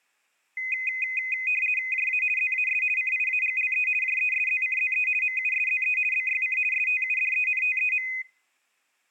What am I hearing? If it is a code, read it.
RTTY (50 baud, 450 Hz shift), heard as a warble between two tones, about 2250 Hz centre. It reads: JA ZAS CIAGLE JESZCZE MUSZE BYC STUDENTEM